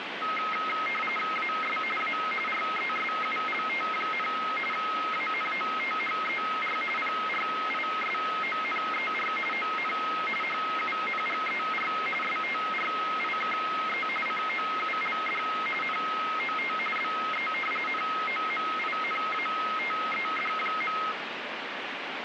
RTTY (45.45 baud, 850 Hz shift), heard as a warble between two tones, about 1700 Hz centre, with radio static. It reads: AS A RESULT, ANOTHER PRISONER ON HUNGER STRIKE COULD NOT BE NOMINATED.